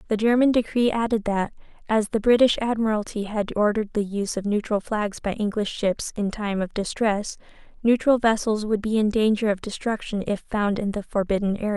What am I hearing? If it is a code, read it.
Speech in English. There is no code.